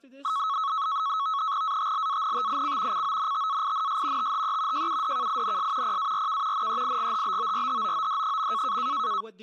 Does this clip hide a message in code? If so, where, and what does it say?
Yes: NAVTEX (SITOR-B), 100 baud, 170 Hz shift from 0.2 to 9.2 s, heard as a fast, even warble, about 1200 Hz centre, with speech in English. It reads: ATLANTIC CONTAINS THE JUDKINS PARK NEIGHBORHOOD.